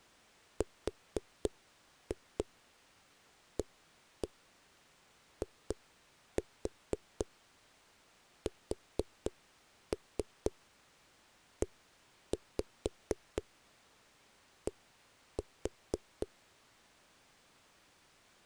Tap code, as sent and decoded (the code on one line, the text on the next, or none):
4-2 1-1 2-4 4-3 1-5 1-4
RAISED